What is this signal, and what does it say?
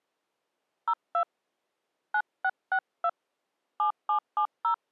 DTMF, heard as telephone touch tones, dialled by hand, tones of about 80 ms. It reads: 02 9662 7770